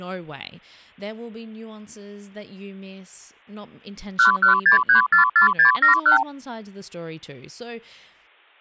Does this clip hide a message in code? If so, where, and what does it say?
Yes: multi-frequency trunk signalling (R2, with the far end's replies) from 4.2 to 6.2 s, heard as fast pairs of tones, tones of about 120 ms, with speech in English. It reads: 116344671